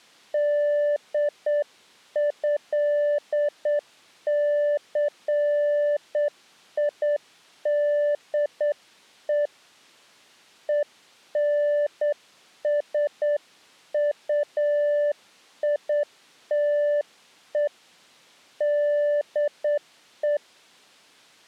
Morse code (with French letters), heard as a keyed tone, hand-sent with a straight key, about 8 wpm, 590 Hz. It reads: DÉCIDE ENSUITE DE